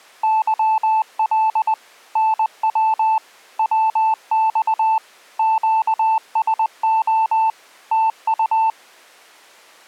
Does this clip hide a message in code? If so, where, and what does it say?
Yes: Morse code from 0.2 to 8.8 s, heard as a keyed tone, machine-sent, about 20 wpm, 880 Hz. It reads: YL NW WX QSO TU